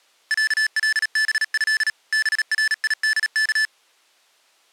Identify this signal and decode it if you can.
Morse code (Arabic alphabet), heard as electronic beeps, machine-sent, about 37 wpm, 1750 Hz. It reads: علبه بريدك